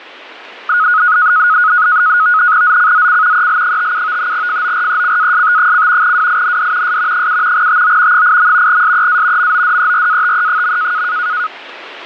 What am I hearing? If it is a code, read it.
NAVTEX (SITOR-B), 100 baud, 170 Hz shift, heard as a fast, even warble, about 1360 Hz centre, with radio static. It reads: ZCZC EL57 FORECAST: WIND S 7 TO 8. SEA MODERATE.